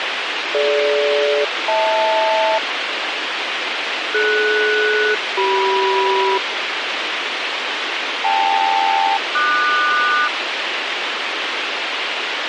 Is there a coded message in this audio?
Yes: aircraft SELCAL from 0.5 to 10.3 s, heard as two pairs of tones, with radio hiss. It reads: DG-HL DS-CM KL-QS